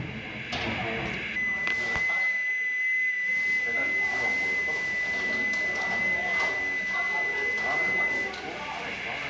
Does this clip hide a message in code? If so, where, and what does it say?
Yes: FT8 (one signal) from 1.3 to 8.3 s, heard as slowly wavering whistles, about 6.25 baud, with radio static, a narrow filter, room echo and the noise of a crowd indoors.